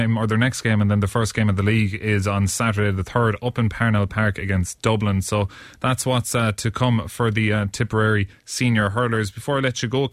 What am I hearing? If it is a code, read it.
Speech in English. There is no code.